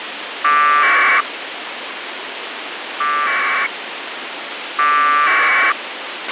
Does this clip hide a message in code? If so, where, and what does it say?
Yes: packet radio (AX.25, as in APRS), 1200 baud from 0.4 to 5.7 s, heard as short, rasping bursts, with radio hiss and a squelch burst at the end.